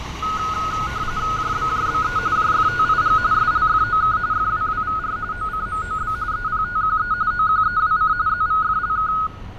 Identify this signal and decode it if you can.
RTTY (45.45 baud, 170 Hz shift), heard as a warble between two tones, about 1360 Hz centre, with fading and street noise. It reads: JBJBE JFTIG SLFOK FWWVR OCMOB EPTQE OQEWC ZVFLK